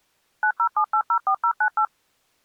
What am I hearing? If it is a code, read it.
DTMF, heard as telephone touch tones, dialled by machine, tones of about 80 ms. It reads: 907804098